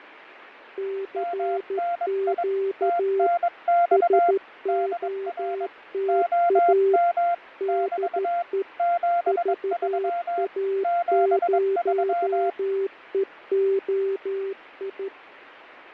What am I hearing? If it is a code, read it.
Morse code, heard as two keyed tones, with radio static and fading. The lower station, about 13 wpm, 390 Hz: CQ SOTA DE VA0EOI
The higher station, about 22 wpm, 690 Hz: MNI TNX DR OM <BT> 73 73